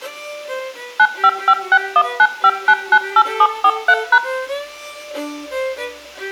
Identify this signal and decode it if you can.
DTMF, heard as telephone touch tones, dialled by machine, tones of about 60 ms, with room echo. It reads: 9556195998743#